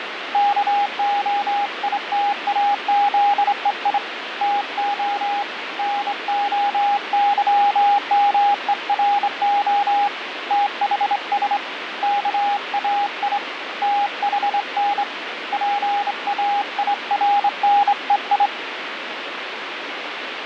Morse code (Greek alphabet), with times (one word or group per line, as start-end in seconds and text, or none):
0.3-4.0 ΚΟΙΤΑΖΕΙ
4.4-5.4 ΤΟ
5.8-10.1 ΝΟΥΜΕΡΟ
10.5-11.6 ΤΗΣ
12.0-13.4 ΚΑΙ
13.8-15.0 ΤΗΝ
15.5-18.5 ΠΑΙΡΝΕΙ